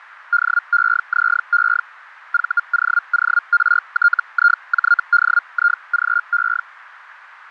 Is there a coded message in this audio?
Yes: Hellschreiber (Feld-Hell, 122.5 baud) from 0.3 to 6.6 s, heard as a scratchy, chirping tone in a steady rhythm, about 1410 Hz, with radio static. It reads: DEZE VOORTIJDIGE